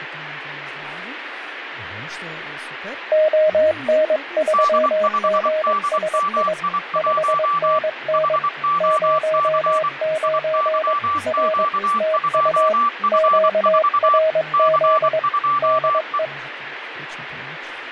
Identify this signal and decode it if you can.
Morse code, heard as two keyed tones, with radio static and speech in Croatian. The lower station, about 22 wpm, 630 Hz: ON3GSI 5NN 09 R TU QRZ DE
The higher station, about 24 wpm, 1160 Hz: D5DMI1 HOC IYQ2F4 C2E